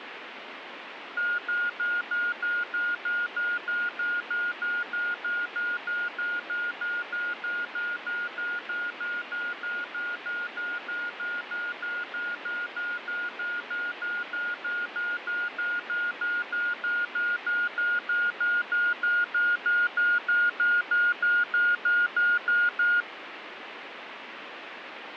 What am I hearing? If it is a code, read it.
Evenly repeated beeps, with radio static and fading. There is no code.